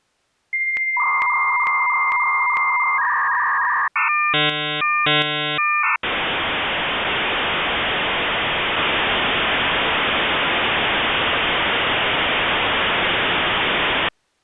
Dial-up modem handshake (V.34 or later), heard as a whistle, warbles, then hiss.